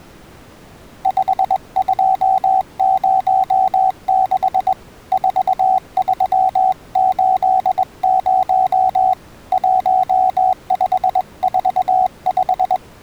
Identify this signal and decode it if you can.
Morse code, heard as a keyed tone, hand-sent with a straight key, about 21 wpm, 750 Hz. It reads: 5206 4380 1545